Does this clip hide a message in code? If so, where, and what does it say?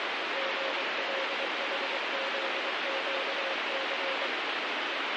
Yes: Morse code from 0.3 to 4.3 s, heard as a keyed tone, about 23 wpm, 540 Hz, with heavy radio static. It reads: GLHZQC